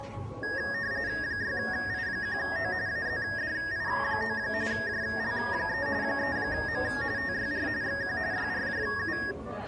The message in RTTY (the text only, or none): 6I1O AZDI9 JL3 3M TYR XQ YRJU